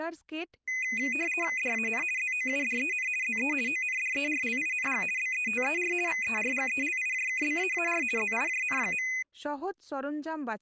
RTTY (50 baud, 450 Hz shift), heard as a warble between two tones, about 2250 Hz centre, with speech in Santali. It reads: DAN ZOUDEN ZE ONDERLING BETER VERGELIJKBAAR ZIJN.